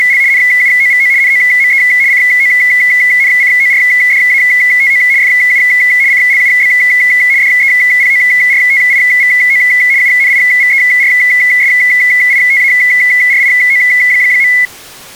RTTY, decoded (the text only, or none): … NUOVO NOME CONCORDATO FU CLUB DEPORTIVO UNIVERSITARIO.